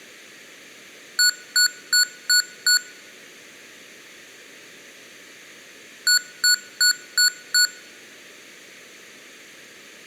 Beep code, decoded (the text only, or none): 5 short